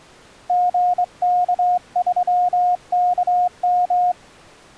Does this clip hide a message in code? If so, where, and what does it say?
Yes: Morse code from 0.4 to 4.2 s, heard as a keyed tone, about 23 wpm, 720 Hz. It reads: GK3KM